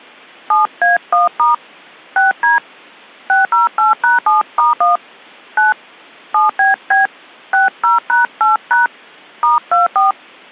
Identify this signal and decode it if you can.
DTMF, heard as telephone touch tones, dialled by hand, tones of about 150 ms. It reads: 7A1* 6D 608#7*1 9 7BB 60#8# *24